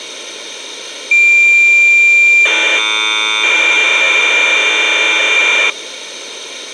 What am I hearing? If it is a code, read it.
Cassette data (Kansas City type), 1200 baud, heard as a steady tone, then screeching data.